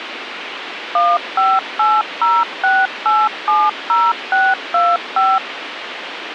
DTMF, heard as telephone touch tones, dialled by machine, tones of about 220 ms, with radio hiss and a squelch burst at the end. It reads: 15806870625